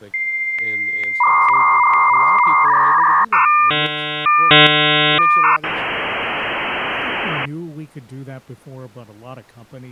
Dial-up modem handshake (V.34 or later), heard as a whistle, warbles, then hiss, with speech in English.